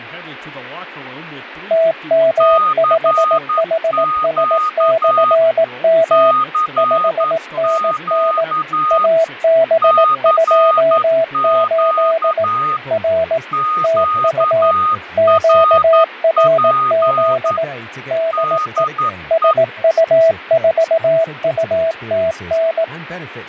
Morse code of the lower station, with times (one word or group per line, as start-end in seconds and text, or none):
1.7-6.3 TM5HS/M
6.8-8.4 5NN
8.9-12.4 AB28
12.9-13.4 R
13.8-14.7 TU
15.2-17.6 QRZ
18.1-18.8 DE
19.3-22.8 SU4UTN